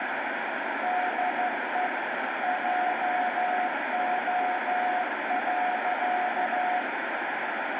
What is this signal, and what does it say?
Morse code, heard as a keyed tone, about 13 wpm, 730 Hz, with heavy radio static. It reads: DE JO.